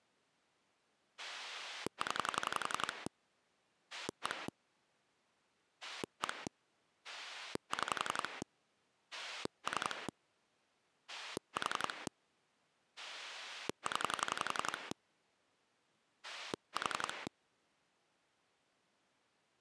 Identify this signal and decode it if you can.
Pulse dialling, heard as a rotary dial, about 11 pulses a second. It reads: 0 1 1 6 3 4 0 4